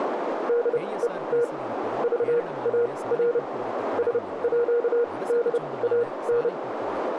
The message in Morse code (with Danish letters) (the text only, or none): DET VAR SÅDAN